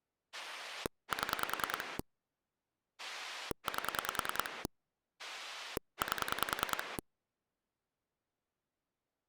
Pulse dialling, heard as a rotary dial, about 10 pulses a second. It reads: 7 8 8